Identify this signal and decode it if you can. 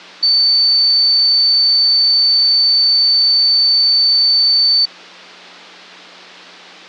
A steady tone. There is no code.